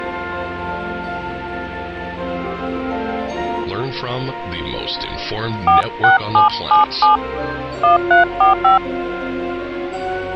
DTMF, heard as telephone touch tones, dialled by hand, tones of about 130 ms. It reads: 46777 1345